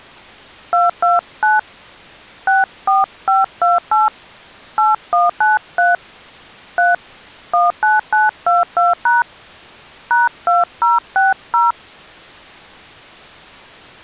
DTMF, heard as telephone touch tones, dialled by hand, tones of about 170 ms. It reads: 229 64528 8193 3 19922# #2060